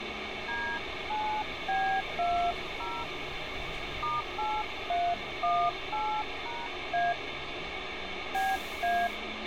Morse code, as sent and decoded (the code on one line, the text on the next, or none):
none